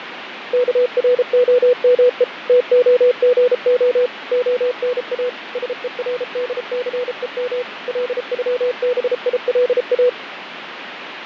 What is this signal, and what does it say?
Morse code (Russian alphabet), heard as a keyed tone, machine-sent, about 33 wpm, 500 Hz, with radio static and fading. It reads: КРОМЕ ТОГО ОНА СЕРДЦЕМ ЛЮБИЛА